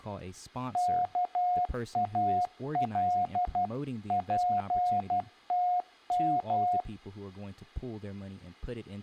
Morse code (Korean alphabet), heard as a keyed tone, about 12 wpm, 720 Hz, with speech in English. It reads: 옥점